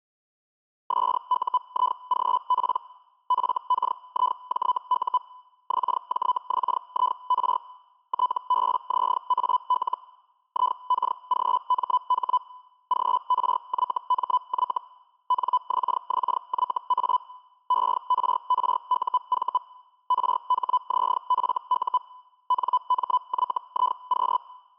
Hellschreiber (Feld-Hell, 122.5 baud), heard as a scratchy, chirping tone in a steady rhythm, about 1000 Hz. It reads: SUIGP FKIJU XJXIR TBZAL IKGMH GRYMY NXXYA ERRUV RHZFU NMYIQ